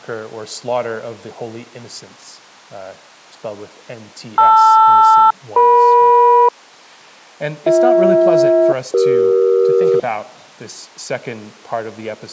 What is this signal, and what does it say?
Aircraft SELCAL, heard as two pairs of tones. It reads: LR-EM BH-CE